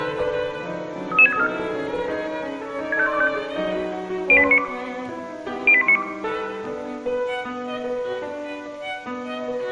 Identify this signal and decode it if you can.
Five-tone selective call (ZVEI), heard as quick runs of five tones, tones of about 70 ms, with room echo. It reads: 33634 65125 08192 08192